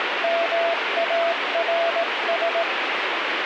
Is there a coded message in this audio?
Yes: Morse code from 0.2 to 2.7 s, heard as a keyed tone, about 18 wpm, 670 Hz, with radio static. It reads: MARS